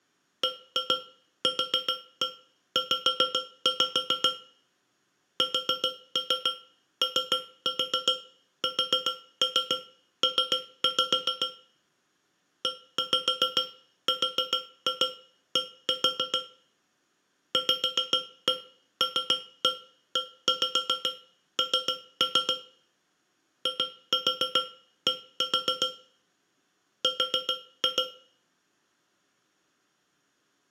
Tap code, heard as taps on a metal pipe, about 7 knocks a second, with room echo. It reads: BQZ SOSP ERD VLEN ID R